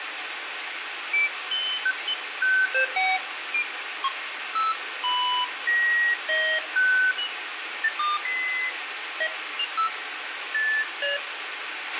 Electronic bleeps of random pitch and length, with radio hiss and a squelch burst at the end. There is no code.